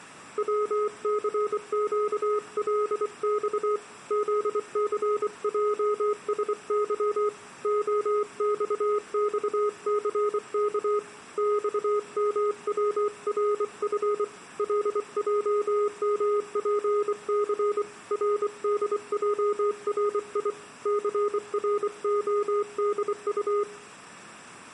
Morse code, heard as a keyed tone, hand-sent with a bug key, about 24 wpm, 420 Hz, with room echo. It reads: WCQLX ZCJSY OXXCK XMWRF LJMPC RDJRI CRODU